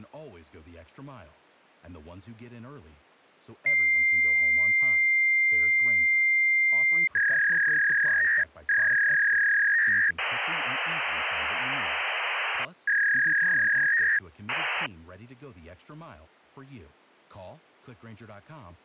Fax machine handshake, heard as a long tone, a warble and hiss, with speech in English.